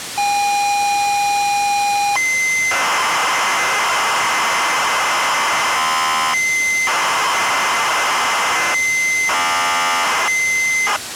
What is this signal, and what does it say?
ZX Spectrum tape loading, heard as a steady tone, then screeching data, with tape hiss.